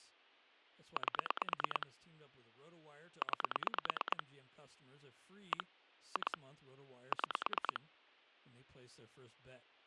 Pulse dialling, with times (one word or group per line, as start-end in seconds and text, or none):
1.0-1.9 8
3.2-4.2 9
5.5-5.6 1
6.2-6.4 2
7.1-7.8 6